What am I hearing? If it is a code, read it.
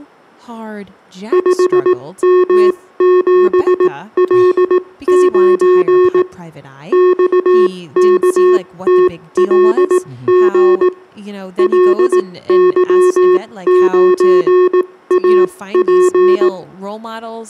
Morse code, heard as electronic beeps, machine-sent, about 18 wpm, spaced as for 15 wpm, 360 Hz, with room echo and speech in English. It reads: 5M7L9 XKTLG LY9AP